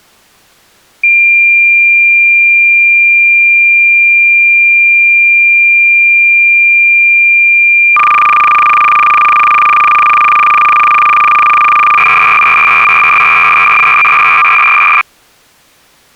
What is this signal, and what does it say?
Cassette data (Kansas City type), 300 baud, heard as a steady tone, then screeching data.